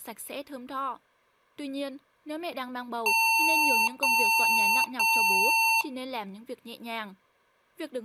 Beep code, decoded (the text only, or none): 3 long